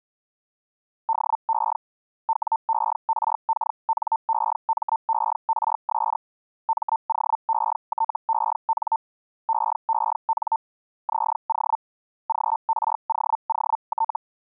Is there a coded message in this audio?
Yes: Hellschreiber (Feld-Hell, 122.5 baud) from 1.1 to 14.2 s, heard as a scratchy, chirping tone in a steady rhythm, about 900 Hz. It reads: DE WERKNEMERS MOETEN EEN ZO GROOT